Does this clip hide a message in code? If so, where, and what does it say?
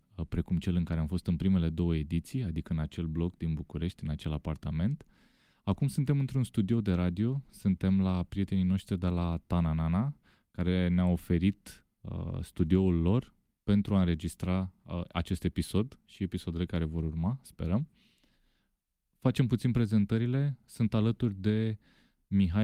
No, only speech in Romanian.